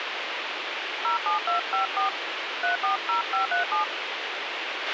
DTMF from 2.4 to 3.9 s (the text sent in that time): 340537